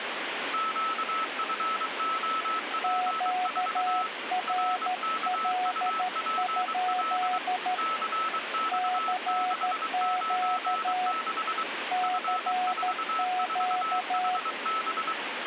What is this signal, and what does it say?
Morse code, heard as two keyed tones, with radio static. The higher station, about 23 wpm, 1310 Hz: QFOP4 RKUPL CX696 F44HB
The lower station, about 13 wpm, 730 Hz: QRL? CQ CQ